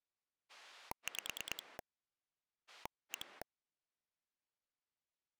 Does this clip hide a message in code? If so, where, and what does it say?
Yes: pulse dialling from 0.5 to 3.4 s, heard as a rotary dial, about 9 pulses a second. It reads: 5 1